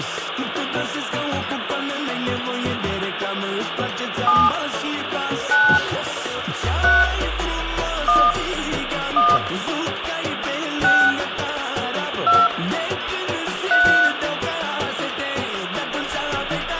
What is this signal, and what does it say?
DTMF, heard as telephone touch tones, dialled by hand, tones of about 260 ms, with phone line noise and room echo. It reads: 7 9 3 1 1 6 2 3